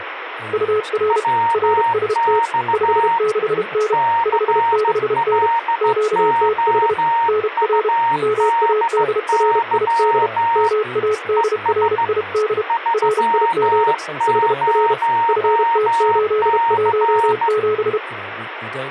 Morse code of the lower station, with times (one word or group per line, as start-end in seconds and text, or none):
0.5-1.2 UR
1.5-2.4 RST
2.7-3.9 56N
4.3-5.5 56N
5.8-6.9 QTH
7.3-7.9 NR
8.2-10.3 MADRID
10.6-12.6 MADRID
12.9-13.9 RIG
14.3-14.9 HR
15.3-18.0 FT817